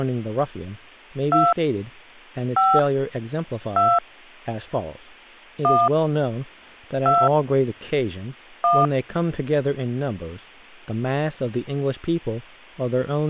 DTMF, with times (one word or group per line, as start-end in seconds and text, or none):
1.3-1.5 2
2.6-2.8 5
3.8-4.0 2
5.6-5.9 1
7.1-7.3 2
8.6-8.9 1